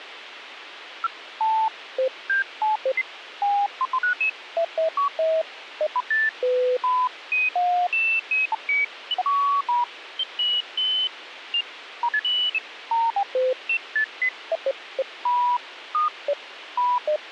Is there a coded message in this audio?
No, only electronic bleeps of random pitch and length, with radio hiss.